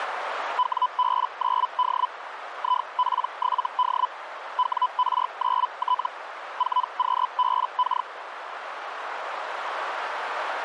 Hellschreiber (Feld-Hell, 122.5 baud), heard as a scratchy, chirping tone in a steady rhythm, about 1000 Hz, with radio static and a narrow filter. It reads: WB9D IP7D WR9T 4QBK